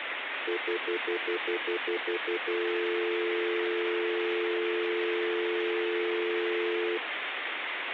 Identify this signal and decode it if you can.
Telephone call progress tone (North American plan), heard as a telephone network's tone, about 350, 440 Hz, 0.1 s on and 0.1 s off, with phone line noise. Stutter dial tone.